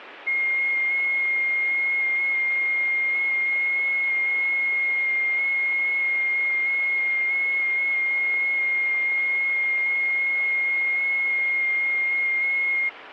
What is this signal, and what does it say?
FT8 (one signal), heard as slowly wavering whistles, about 6.25 baud.